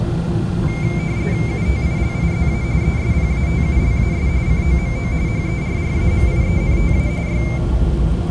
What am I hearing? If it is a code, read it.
RTTY (45.45 baud, 170 Hz shift), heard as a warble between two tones, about 2200 Hz centre, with the noise inside a subway train. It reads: UTILIZA ESPATULAS COMO HERRAMIENTA Y